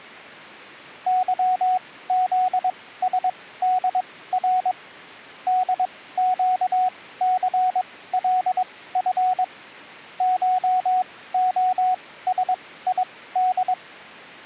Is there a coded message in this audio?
Yes: Morse code (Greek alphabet) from 1.0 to 13.8 s, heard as a keyed tone, machine-sent, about 22 wpm, spaced as for 16 wpm, 740 Hz. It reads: ΥΖΣΔΡ ΔΨΘΛΦ ΧΟΣΙΔ